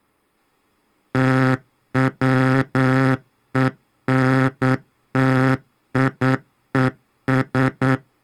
Morse code, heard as a buzzer, machine-sent, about 9 wpm. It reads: TWENTIES